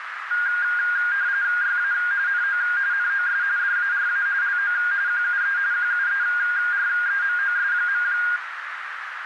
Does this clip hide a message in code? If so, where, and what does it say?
Yes: RTTY (45.45 baud, 170 Hz shift) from 0.3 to 8.4 s, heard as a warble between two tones, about 1500 Hz centre, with radio static and a narrow filter. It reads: YA NO NOS DARA LO QUE QUEREMOS.